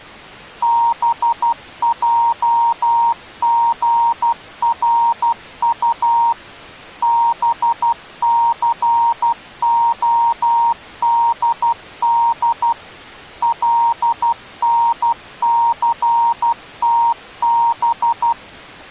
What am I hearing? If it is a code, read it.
Morse code, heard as a keyed tone, machine-sent, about 12 wpm, 930 Hz. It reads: BJGRU BCODD LNCTB